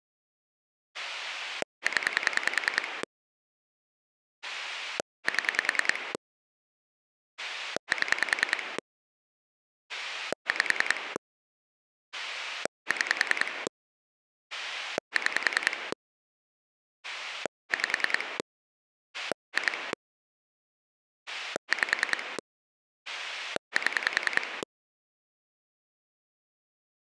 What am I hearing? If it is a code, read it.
Pulse dialling, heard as a rotary dial, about 10 pulses a second. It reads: 0 7 7 5 6 6 5 2 5 7